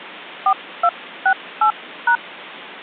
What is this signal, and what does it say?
DTMF, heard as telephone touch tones, dialled by hand, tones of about 90 ms. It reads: 4268#